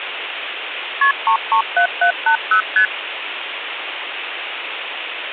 Multi-frequency trunk signalling (R1, as on North American trunks), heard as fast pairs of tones, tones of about 90 ms, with phone line noise. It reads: KP 337780 ST